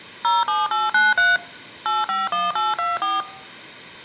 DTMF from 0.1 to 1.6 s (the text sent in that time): 07893